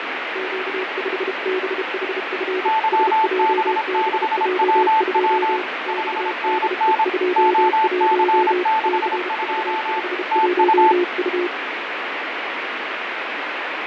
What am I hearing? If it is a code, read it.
Morse code, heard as two keyed tones, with heavy radio static and fading. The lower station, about 32 wpm, 360 Hz: Q5BHF SJBJ2 XDE21 CV51U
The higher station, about 26 wpm, 880 Hz: YB6WW 5NN OC62 TU